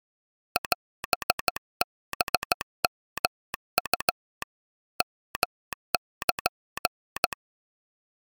Morse code (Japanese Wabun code), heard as a telegraph sounder, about 15 wpm. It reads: オハヨウ ヨル